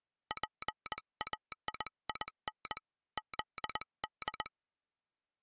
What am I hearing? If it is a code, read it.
Morse code (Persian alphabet), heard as a telegraph sounder, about 20 wpm. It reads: پایین زد